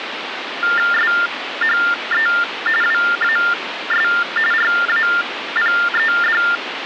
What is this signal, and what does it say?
TTY/TDD text telephone tones (45.45 baud Baudot), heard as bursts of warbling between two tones, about 400 Hz shift, 1600 Hz centre, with phone line noise. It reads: SHE WAS RAPED